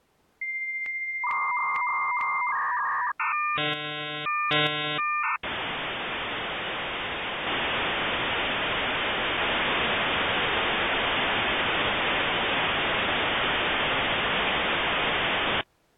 Dial-up modem handshake (V.34 or later), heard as a whistle, warbles, then hiss.